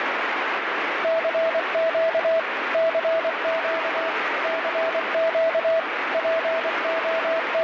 Morse code, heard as a keyed tone, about 24 wpm, 650 Hz, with heavy radio static. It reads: CQ CQ CQ …